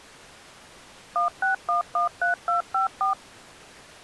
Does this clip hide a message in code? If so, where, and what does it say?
Yes: DTMF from 1.2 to 3.1 s, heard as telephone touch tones, dialled by machine, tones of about 130 ms. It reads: 16113254